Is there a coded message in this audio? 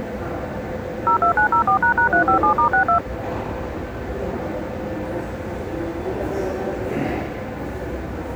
Yes: DTMF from 1.1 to 3.0 s, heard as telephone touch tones, dialled by machine, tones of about 100 ms, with the noise of a subway station. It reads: 02904##357*62